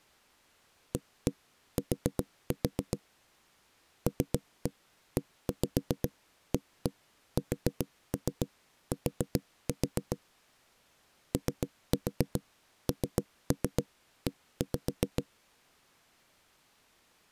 Tap code, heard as knocks on a wall, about 7 knocks a second. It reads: AT LEAST ONE